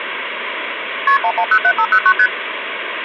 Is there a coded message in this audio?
Yes: multi-frequency trunk signalling (R1, as on North American trunks) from 1.1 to 2.3 s, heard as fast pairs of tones, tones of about 70 ms, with phone line noise. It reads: KP 1107509 ST